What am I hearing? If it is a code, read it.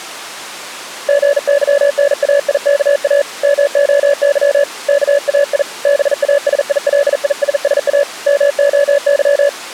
Morse code (Greek alphabet), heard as a keyed tone, hand-sent with a bug key, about 40 wpm, 570 Hz. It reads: ΓΥΝΑΙΚΑ ΜΟΥ ΚΑΙ ΒΑΣΙΛΙΣΣΑ ΜΟΥ